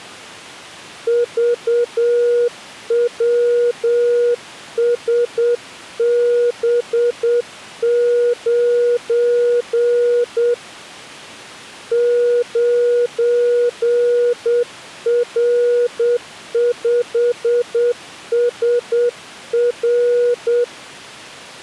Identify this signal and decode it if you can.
Morse code, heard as a keyed tone, hand-sent with a paddle, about 8 wpm, 480 Hz. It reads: VWSB9 9R5SR